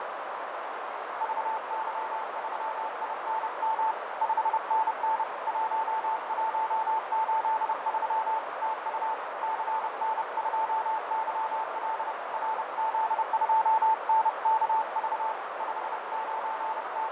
Morse code, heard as a keyed tone, hand-sent with a paddle, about 30 wpm, 880 Hz, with heavy radio static, fading and a narrow filter. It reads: VY3INM 5NN 1183 TU CN2YL RZ2NKV …